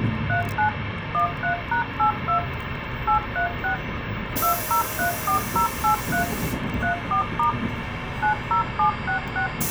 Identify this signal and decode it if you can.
DTMF, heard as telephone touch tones, dialled by machine, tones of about 110 ms, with phone line noise and the noise inside a bus. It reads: 39 13#82 836 2034083 34* 90766